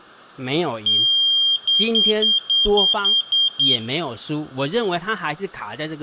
Beep code, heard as a piezo beeper, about 3200 Hz, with room echo and speech in Chinese. 1 long, 8 short. In AMI BIOS tables: display or retrace test failure.